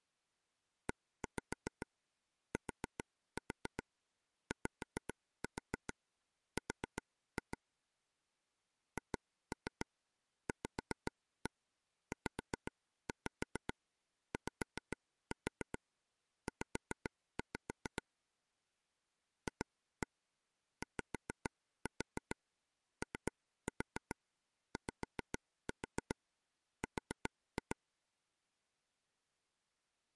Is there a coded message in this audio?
Yes: tap code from 0.9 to 27.7 s, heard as taps on a table, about 7 knocks a second. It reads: ETYR HVZYZ FYOYR